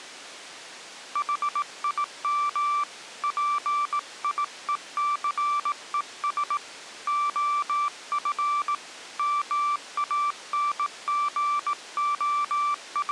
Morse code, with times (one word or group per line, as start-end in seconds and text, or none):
1.2-2.8 HIM
3.2-6.6 PIECES
7.1-8.7 OF
9.2-13.1 …